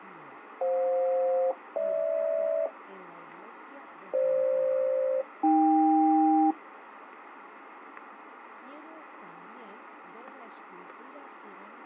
Aircraft SELCAL, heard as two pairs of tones, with radio static. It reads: FJ-GH FG-AK